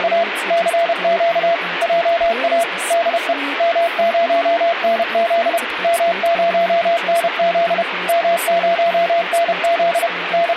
Morse code, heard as a keyed tone, machine-sent, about 31 wpm, 680 Hz, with radio static and speech in English. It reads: … CQ JA DE M0NZ M0NZ M0NZ …